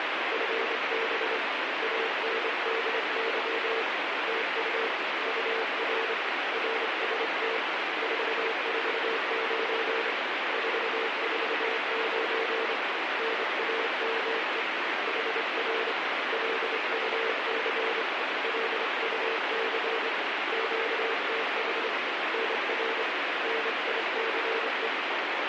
Morse code, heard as a keyed tone, hand-sent with a straight key, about 26 wpm, 450 Hz, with heavy radio static. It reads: FB ANDY TU UR RST 449 449 NAME HR LUC LUC QTH NR NICE